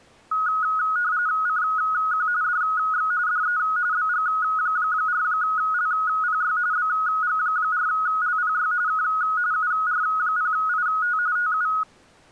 RTTY (45.45 baud, 170 Hz shift), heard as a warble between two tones, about 1360 Hz centre. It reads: CQ DX DE BG4LPY BG4LPY K UR0IT TU